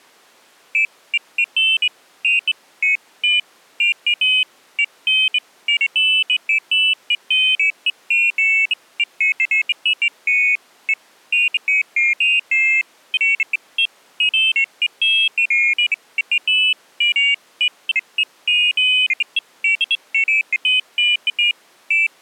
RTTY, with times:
none

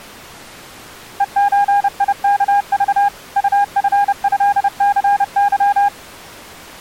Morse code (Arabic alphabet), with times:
1.2-3.1 ءزيكض
3.4-5.9 طفهثظ

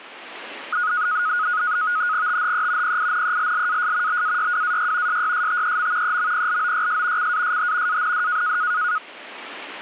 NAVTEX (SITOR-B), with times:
2.3-3.0 THE
2.8-4.2 PINELLAS
4.1-5.2 BAYWAY
5.1-6.2 SYSTEM
6.0-7.3 EMPLOYS
7.2-8.0 CASH
7.9-8.6 AND

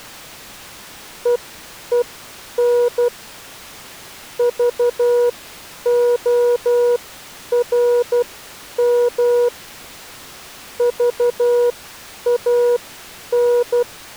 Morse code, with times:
1.3-3.1 EEN
4.4-9.5 VORM
10.8-13.8 VAN

